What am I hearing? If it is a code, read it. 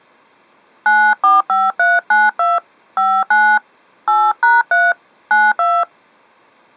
DTMF, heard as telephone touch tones, dialled by hand, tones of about 220 ms. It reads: 945392 59 8#3 92